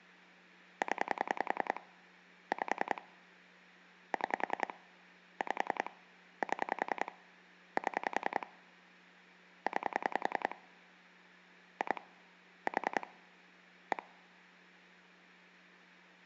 Pulse dialling, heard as clicks on a phone line, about 10 pulses a second, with hum. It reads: 0 5 6 5 7 7 9 2 4 1